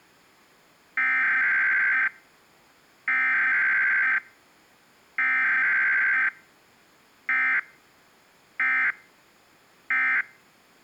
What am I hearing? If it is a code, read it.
Emergency Alert System (SAME) tones (header bursts, then end-of-message bursts), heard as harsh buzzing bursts, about 520.83 baud.